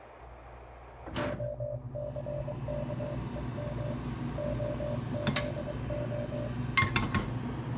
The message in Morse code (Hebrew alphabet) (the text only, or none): הסכום הזה